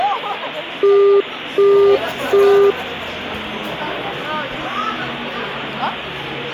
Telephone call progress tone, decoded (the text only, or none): busy tone